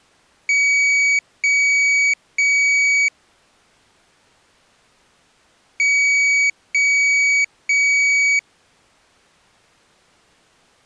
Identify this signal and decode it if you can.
Beep code, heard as a piezo beeper, played twice, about 2250 Hz. 3 long. In IBM BIOS tables: keyboard card error.